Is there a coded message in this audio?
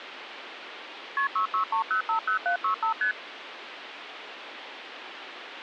Yes: multi-frequency trunk signalling (R1, as on North American trunks) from 1.2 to 3.1 s, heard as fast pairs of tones, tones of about 100 ms, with phone line noise. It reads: KP 663050765 ST